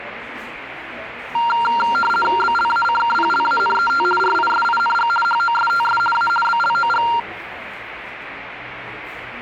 RTTY (50 baud, 450 Hz shift), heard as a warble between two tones, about 1160 Hz centre, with the noise of a cafe. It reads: BLACKPLANET RISING HOSTS A BLOG